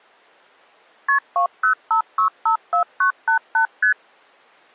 Multi-frequency trunk signalling (R1, as on North American trunks), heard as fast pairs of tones, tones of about 100 ms. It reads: KP 205654988 ST